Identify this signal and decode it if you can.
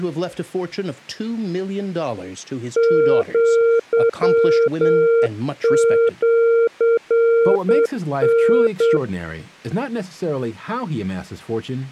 Morse code (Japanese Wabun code), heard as a keyed tone, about 8 wpm, 460 Hz, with speech in English. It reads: アシタ